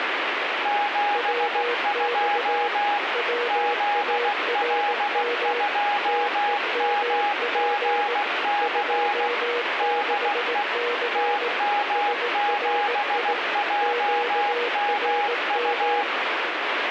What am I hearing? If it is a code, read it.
Morse code, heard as two keyed tones, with radio static. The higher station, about 16 wpm, 820 Hz: 72 ZL2MGC DE TM7JMU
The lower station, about 18 wpm, 480 Hz: WX WARM TEMP 26C SRI QRM